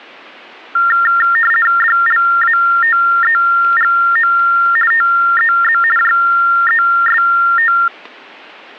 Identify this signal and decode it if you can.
RTTY (50 baud, 450 Hz shift), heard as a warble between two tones, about 1600 Hz centre. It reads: DLATEGO TEZ JEST